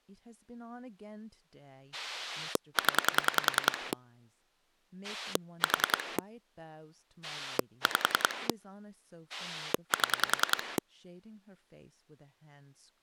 Pulse dialling, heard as a rotary dial, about 10 pulses a second, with speech in English. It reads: 0 4 5 7